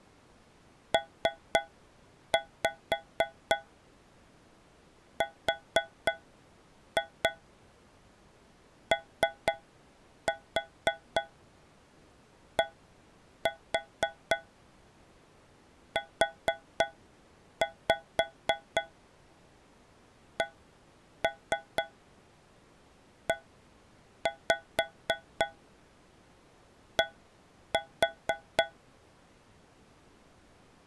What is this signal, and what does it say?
Tap code, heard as taps on a metal pipe, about 4 knocks a second. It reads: PRODUCED